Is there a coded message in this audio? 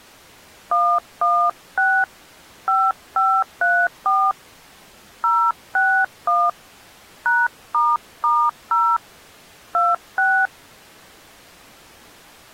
Yes: DTMF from 0.7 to 10.5 s, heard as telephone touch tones, dialled by hand, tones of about 250 ms. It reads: 116 5534 061 #**0 26